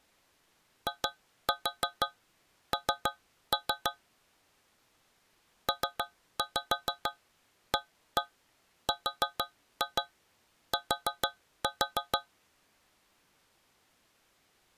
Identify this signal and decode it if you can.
Tap code, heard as taps on a metal pipe, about 6 knocks a second. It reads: IN PART